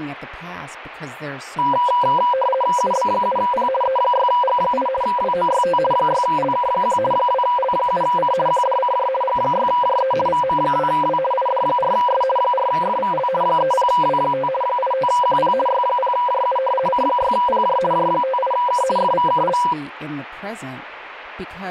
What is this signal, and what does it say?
RTTY (50 baud, 450 Hz shift), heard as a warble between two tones, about 750 Hz centre, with radio static and speech in English. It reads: UB7P E6G8 WOYT 6LK1 2L7C QDCJ G6JE VM2W ID4S 4FVL 30W5 85QP Y0JU C6PJ J58K FVKL